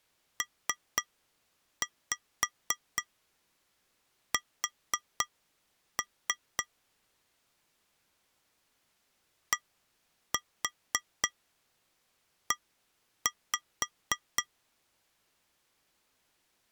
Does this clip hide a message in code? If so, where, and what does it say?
Yes: tap code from 0.4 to 14.5 s, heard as taps on glass, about 4 knocks a second. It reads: PS DE